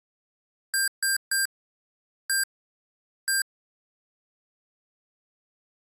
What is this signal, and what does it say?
Beep code, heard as beeps from a small speaker, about 1600 Hz. 3-1-1. In Phoenix BIOS tables: DMA register failure.